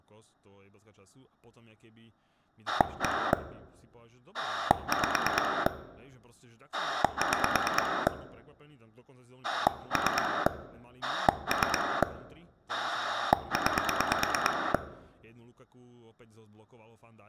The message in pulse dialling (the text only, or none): 1 5 6 3 3 9